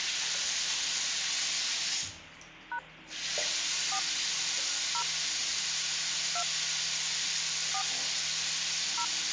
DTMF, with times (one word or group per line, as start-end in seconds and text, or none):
2.7-2.8 #
3.9-4.0 4
4.9-5.0 0
6.4-6.4 2
7.7-7.8 4
9.0-9.0 0